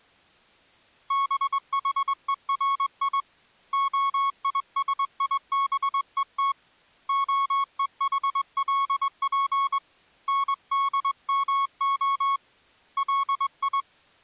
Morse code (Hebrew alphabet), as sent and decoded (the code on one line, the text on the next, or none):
-... .... . .-. .. / --- .. ... .. -... . - / --- . .... .-.. .--. / -. -.. -- --- / .-.. ..
בחורי הישיבות הוחלף נדמה לי